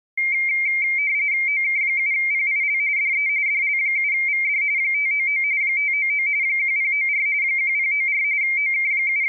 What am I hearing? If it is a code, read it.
RTTY (45.45 baud, 170 Hz shift), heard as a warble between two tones, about 2200 Hz centre. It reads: OK7PIL DE DL7VD 599 599 1094 1094 …